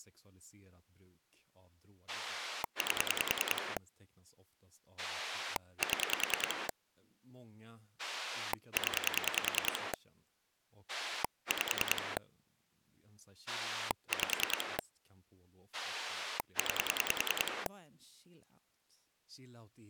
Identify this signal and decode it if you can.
Pulse dialling, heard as a rotary dial, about 10 pulses a second, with speech in Swedish. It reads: 8 7 0 5 5 9